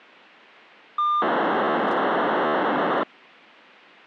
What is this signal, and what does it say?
POCSAG pager data (2400 baud), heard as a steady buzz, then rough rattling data.